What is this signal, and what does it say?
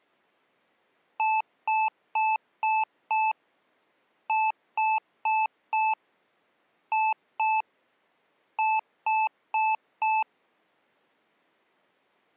Beep code, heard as beeps from a small speaker, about 870 Hz. 5-4-2-4.